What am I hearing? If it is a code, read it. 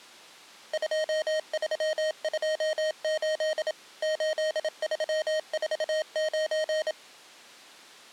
Morse code, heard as electronic beeps, machine-sent, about 27 wpm, 620 Hz. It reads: 2328 8349